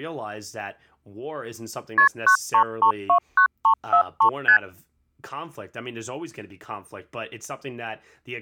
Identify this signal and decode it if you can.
Multi-frequency trunk signalling (R1, as on North American trunks), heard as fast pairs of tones, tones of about 90 ms, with speech in English. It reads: KP 93329343 ST